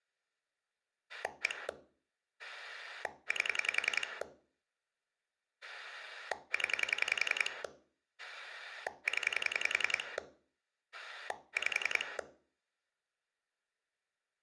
Pulse dialling, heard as a rotary dial, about 10 pulses a second, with room echo. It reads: 1 8 0 0 5